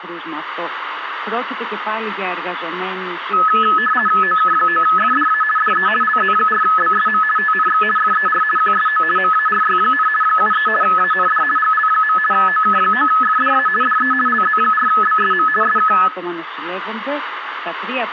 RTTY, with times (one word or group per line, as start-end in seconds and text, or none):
4.2-5.4 OK9FDA
5.6-5.9 DE
6.0-7.2 LZ4BSM
7.4-7.8 TNX
8.0-8.4 FER
8.6-9.0 QSO
9.2-10.1 MARY,
10.2-10.7 73
10.8-11.4 AND
11.6-12.2 GL.
12.3-13.7 OK9FDA
13.8-14.1 DE
14.3-15.5 LZ4BSM
15.6-15.9 SK